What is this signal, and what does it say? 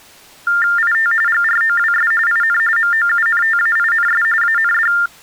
TTY/TDD text telephone tones (45.45 baud Baudot), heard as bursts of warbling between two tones, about 400 Hz shift, 1600 Hz centre. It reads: IT GROWS IN MOUNTAINS AND